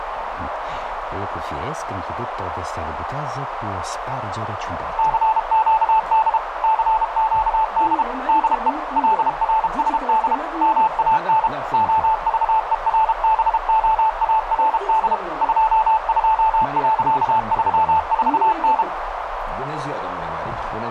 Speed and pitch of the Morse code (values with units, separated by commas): 32 wpm, 880 Hz